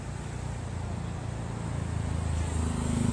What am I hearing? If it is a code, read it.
Street noise. There is no code.